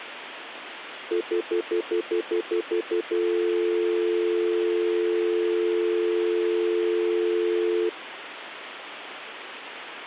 Telephone call progress tone (North American plan), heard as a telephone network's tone, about 350, 440 Hz, 0.1 s on and 0.1 s off, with phone line noise. Stutter dial tone.